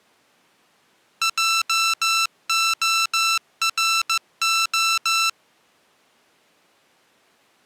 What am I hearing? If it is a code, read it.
Morse code, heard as electronic beeps, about 15 wpm, 1340 Hz. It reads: JORO